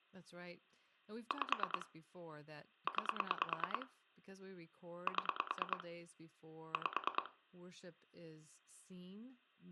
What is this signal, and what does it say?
Pulse dialling, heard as clicks on a phone line, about 9 pulses a second, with speech in English. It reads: 5 9 7 5